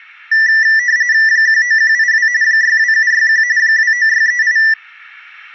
RTTY (45.45 baud, 170 Hz shift), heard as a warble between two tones, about 1850 Hz centre. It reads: 19182 62761 29638